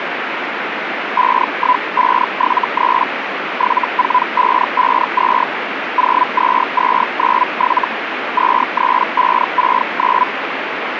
Hellschreiber (Feld-Hell, 122.5 baud), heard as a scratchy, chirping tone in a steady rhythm, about 1000 Hz, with radio static. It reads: 51573 74552 02297 23569